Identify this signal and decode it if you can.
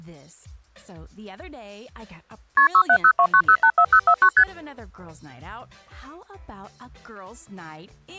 Multi-frequency trunk signalling (R1, as on North American trunks), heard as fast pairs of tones, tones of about 70 ms. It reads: KP 67029084049 ST